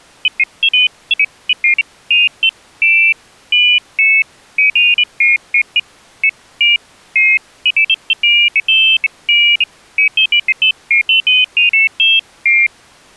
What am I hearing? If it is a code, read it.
Pairs of high tones at irregular times. There is no code.